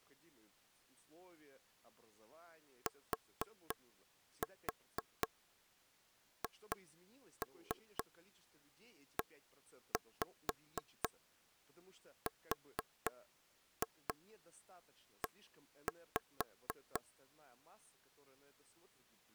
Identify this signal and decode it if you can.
Tap code, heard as taps on a table, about 4 knocks a second, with speech in Russian. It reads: THERE